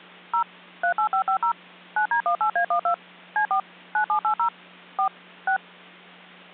DTMF, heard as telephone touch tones, dialled by machine, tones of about 90 ms, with hum. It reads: 0 38550 9D18A12 C4 9780 4 6